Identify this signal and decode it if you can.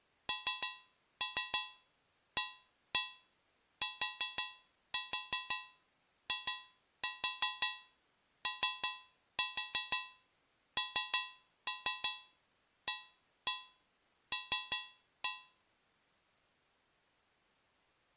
Tap code, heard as taps on a metal pipe, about 5 knocks a second. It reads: NATIONAL